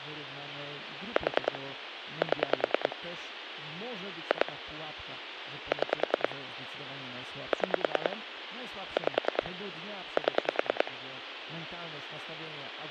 Pulse dialling, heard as clicks on a phone line, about 10 pulses a second, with phone line noise and speech in Polish. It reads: 4 7 2 6 6 5 7